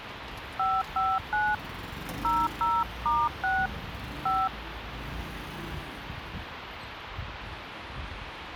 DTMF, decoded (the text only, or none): 559 00*6 5